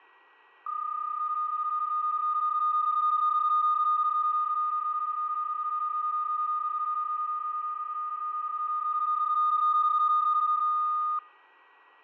PSK31 (31.25 baud), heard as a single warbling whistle, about 1230 Hz, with fading and a steady whistle near 1920 Hz.